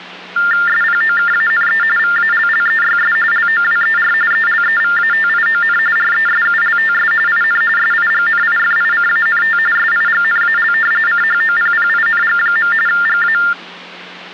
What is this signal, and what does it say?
TTY/TDD text telephone tones (45.45 baud Baudot), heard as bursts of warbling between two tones, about 400 Hz shift, 1600 Hz centre, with hum. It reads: SPOKANE VALLEYS LOWER ELEVATION RESULTS IN SIGNIFICANT SIGNAL CHOPPING. GA